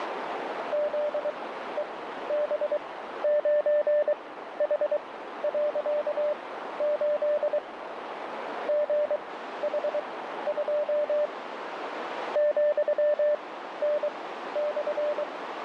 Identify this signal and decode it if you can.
Morse code, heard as a keyed tone, machine-sent, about 23 wpm, spaced as for 13 wpm, 590 Hz, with radio static and a narrow filter. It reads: ZEB9H.8 GH2 ,N/